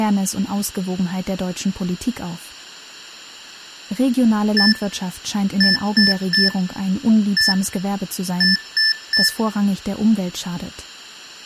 Beep code, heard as beeps from a small speaker, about 1750 Hz, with room echo and speech in German. 1-3-1-3. In Phoenix BIOS tables: keyboard controller test failure.